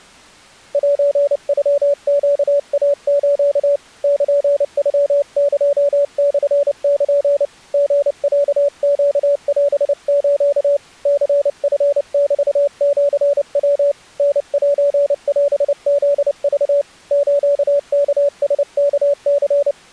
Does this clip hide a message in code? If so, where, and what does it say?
Yes: Morse code (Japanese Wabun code) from 0.7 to 19.8 s, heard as a keyed tone, hand-sent with a paddle, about 29 wpm, 570 Hz. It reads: セノネイス ルノエモル リロネオス ニチメシヤ タセオフク スワラワニ